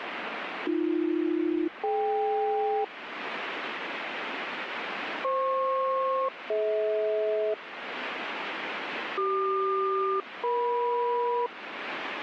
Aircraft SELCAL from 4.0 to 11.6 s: FP-DH CQ-EM

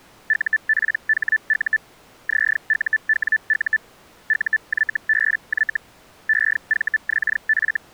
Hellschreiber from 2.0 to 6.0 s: ZUWU UYBY

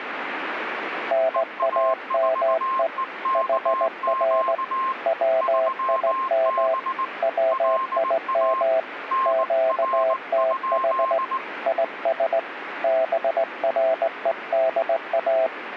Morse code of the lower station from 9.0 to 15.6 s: QTH IS BREDA

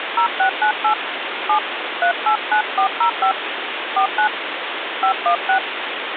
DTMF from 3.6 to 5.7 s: 49 516

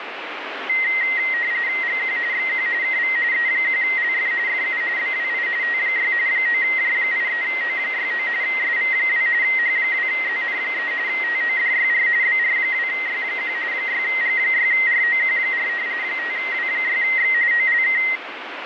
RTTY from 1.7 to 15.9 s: GQ XQ KV E1LF FU BWI T6 9J83O69 SV2 H2ZN3 TODYR BR2Y1 6G6ROQ4

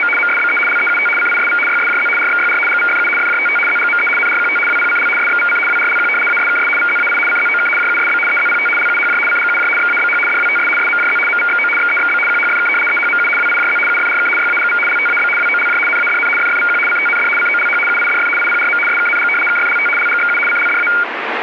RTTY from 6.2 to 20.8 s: ASKS VZAI CZOK JUSB EZPT LUHJ CGUJ XABH DWTS SMJZ MVXO XEXB QHFK EHMU WIJZ UFRK YAGV LTAB WOLJ NADN FFVQ CTND COLH UIDF IPRM SKNG KFLT LGXU CLDA

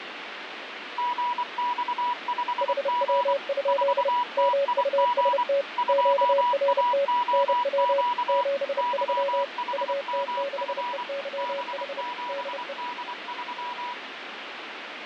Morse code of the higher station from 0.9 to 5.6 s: GX5G 4TIG

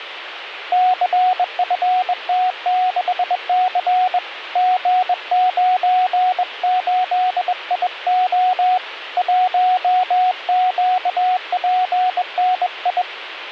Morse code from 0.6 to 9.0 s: CFT6C G98IO

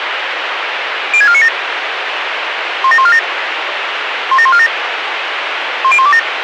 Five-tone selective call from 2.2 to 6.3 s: 17147 17147 10127

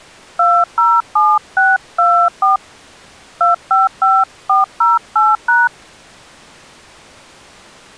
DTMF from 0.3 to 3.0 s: 207624

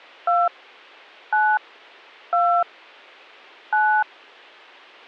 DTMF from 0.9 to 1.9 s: 9

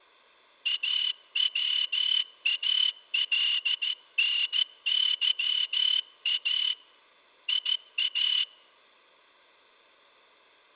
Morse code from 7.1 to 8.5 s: IA

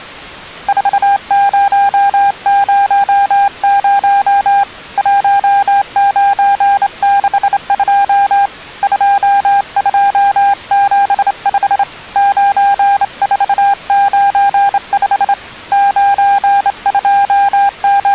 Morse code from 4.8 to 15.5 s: 1962 2275 9495

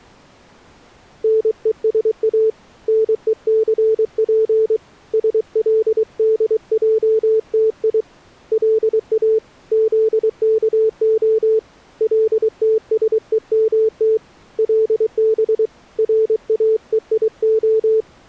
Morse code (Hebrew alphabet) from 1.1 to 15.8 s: נושא נוסף שלדעתי לא זכה לתשומת לב

